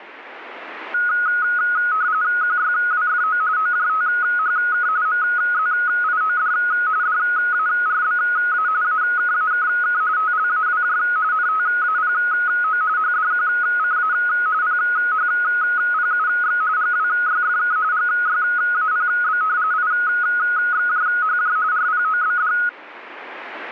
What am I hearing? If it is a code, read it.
RTTY (45.45 baud, 170 Hz shift), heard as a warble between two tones, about 1360 Hz centre. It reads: QYWFO OJTHK MZIOD DARBA AKAKK TLAWJ NTAPO HDQCA PHPUX GWYFK GYAPB IXJHJ RPOBD